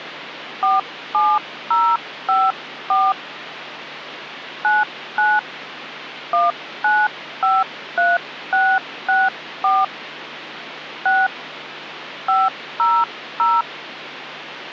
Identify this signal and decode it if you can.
DTMF, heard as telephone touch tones, dialled by hand, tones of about 210 ms, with phone line noise. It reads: 47054 99 1953664 6 500